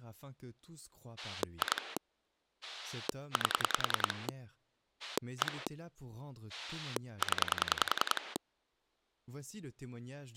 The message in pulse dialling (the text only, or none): 2 8 1 0